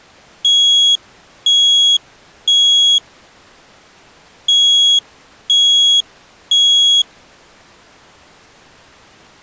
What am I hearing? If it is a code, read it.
Alarm pattern, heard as an alarm's beeps, played twice, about 3300 Hz. Temporal three. Smoke or fire, evacuate.